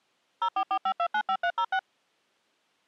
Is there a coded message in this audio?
Yes: DTMF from 0.4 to 1.8 s, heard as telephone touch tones, dialled by machine, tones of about 70 ms. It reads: 0445295306